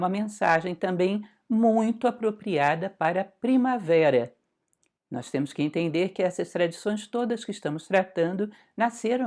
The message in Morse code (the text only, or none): none